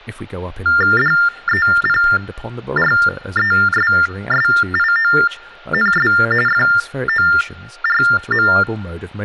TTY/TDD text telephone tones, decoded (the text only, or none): DEPRESSIONS FORM